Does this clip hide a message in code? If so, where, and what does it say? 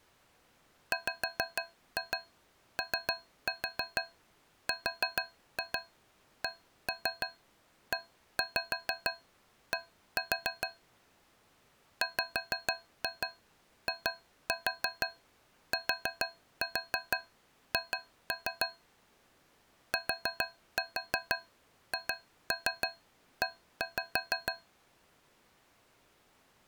Yes: tap code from 0.9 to 24.7 s, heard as taps on a metal pipe, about 6 knocks a second. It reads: WORKED WITH THE